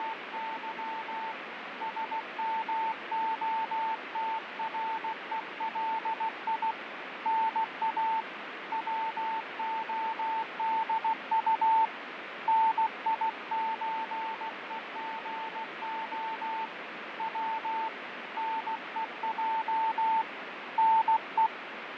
Morse code (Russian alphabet), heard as a keyed tone, hand-sent with a paddle, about 16 wpm, 890 Hz, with radio static and fading. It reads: … СМОТРЕЛИ НА ВОДУ НИЧЕГО В НЕЙ НЕ